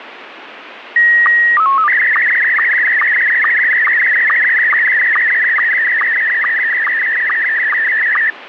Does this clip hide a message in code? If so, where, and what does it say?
Yes: SSTV (slow-scan television), Scottie S1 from 1.0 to 8.3 s, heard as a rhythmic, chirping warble, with radio static.